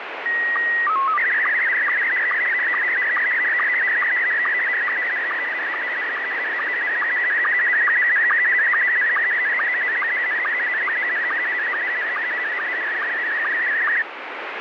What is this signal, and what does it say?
SSTV (slow-scan television), Scottie S1, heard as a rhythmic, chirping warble, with heavy radio static.